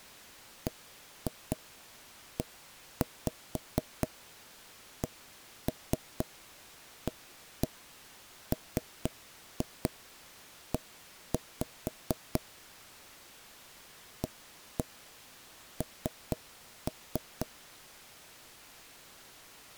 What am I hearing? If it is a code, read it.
Tap code, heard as knocks on wood, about 4 knocks a second. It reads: BECAME AN